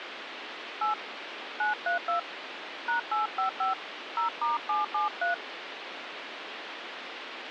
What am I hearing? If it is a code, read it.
DTMF, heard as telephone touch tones, dialled by hand, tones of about 130 ms, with phone line noise. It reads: 8 932 #855 0*773